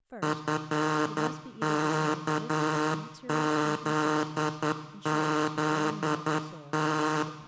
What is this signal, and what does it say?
Morse code, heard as a buzzer, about 10 wpm, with room echo and speech in English. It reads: FKZZT